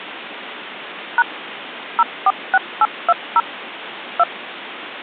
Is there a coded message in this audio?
Yes: DTMF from 1.2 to 4.2 s, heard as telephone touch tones, dialled by machine, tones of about 40 ms, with phone line noise. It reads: # 046820 2